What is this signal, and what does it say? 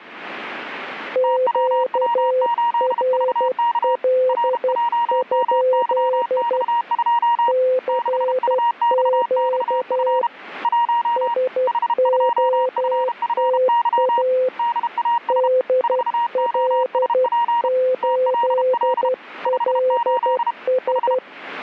Morse code, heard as two keyed tones. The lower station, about 12 wpm, 510 Hz: QRL? CQ SOTA DL8LS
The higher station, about 32 wpm, 940 Hz: TWW8VK RJMYX2 6UXXF 1 H2FFY DAS 4OSP TLL 58 H